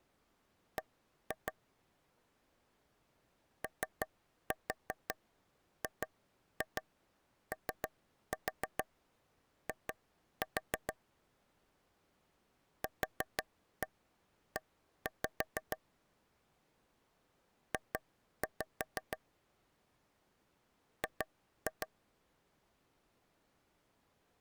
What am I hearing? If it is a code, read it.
Tap code, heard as taps on a table, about 6 knocks a second. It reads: B OGOI QE J G